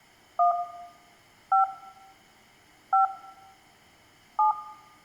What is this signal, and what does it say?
DTMF, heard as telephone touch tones, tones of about 130 ms, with room echo. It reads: 1 5 5 7